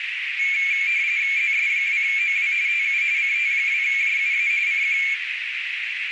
RTTY (45.45 baud, 170 Hz shift), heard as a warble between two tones, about 2300 Hz centre, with radio static and a narrow filter. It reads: ZS2OW TU CT2JUA CQ